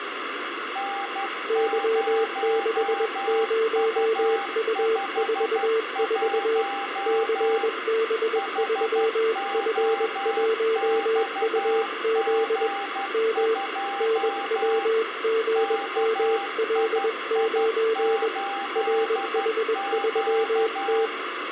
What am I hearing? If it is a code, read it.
Morse code, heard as two keyed tones, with radio static and room echo. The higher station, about 12 wpm, 790 Hz: N0U51 HOXG2 KII8Q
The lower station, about 21 wpm, 450 Hz: Y60U44 CB3F1UZ M NWGML9 RH3T